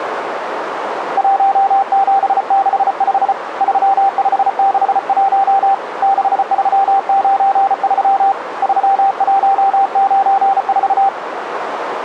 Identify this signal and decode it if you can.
Morse code, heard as a keyed tone, hand-sent with a paddle, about 34 wpm, 780 Hz, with radio static and a narrow filter. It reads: 1765 3561 6393 3194